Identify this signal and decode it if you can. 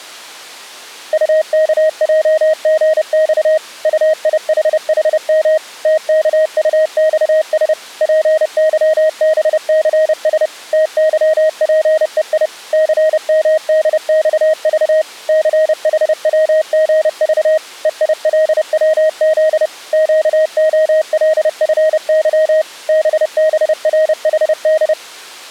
Morse code, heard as a keyed tone, machine-sent, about 30 wpm, 630 Hz. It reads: UKJGX UIHHM TKUXS PYBCS TYPEI CMDXV CHWGV EILWZ QOLFY BBRHD